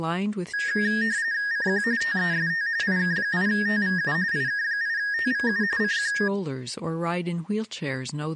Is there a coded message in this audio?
Yes: RTTY (45.45 baud, 170 Hz shift) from 0.5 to 6.3 s, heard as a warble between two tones, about 1750 Hz centre, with speech in English. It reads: CQ TEST IK8TVU IK8TVU CQ